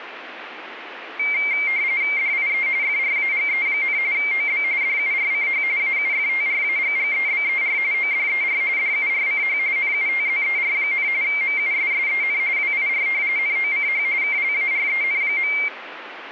RTTY (45.45 baud, 170 Hz shift), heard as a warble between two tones, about 2200 Hz centre, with radio static. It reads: DIE FRAGE, OB DURCH AUFTRAGGEBER ODER DURCH NUTZER, MUSSEN WIR NOCH KLAREN.